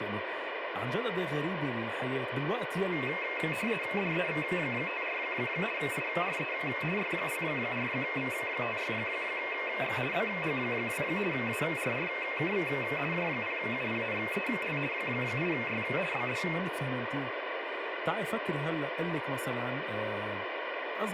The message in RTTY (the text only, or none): DEV54 IRE Y04V56X BG2 ARRKV J0UPNEL 8Y BD